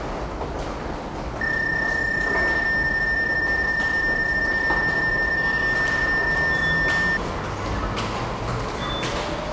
PSK31 (31.25 baud), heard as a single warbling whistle, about 1800 Hz, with the noise of a subway station.